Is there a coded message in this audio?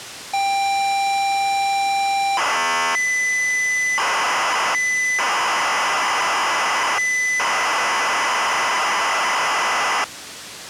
Yes: ZX Spectrum tape loading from 0.3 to 10.0 s, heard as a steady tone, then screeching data.